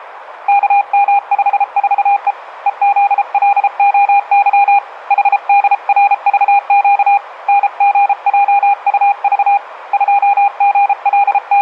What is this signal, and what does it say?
Morse code, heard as a keyed tone, hand-sent with a paddle, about 33 wpm, 810 Hz, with radio static. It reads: KM54E EZLOY HDRVQ NGJUV …